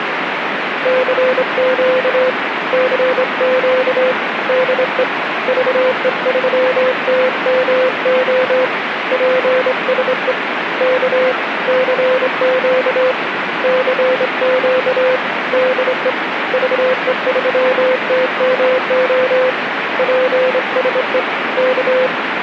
Morse code, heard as a keyed tone, hand-sent with a straight key, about 25 wpm, 510 Hz, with radio static. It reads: CQ CQ DE VE3TMO PSE K CQ CQ DE VE3TMO PSE K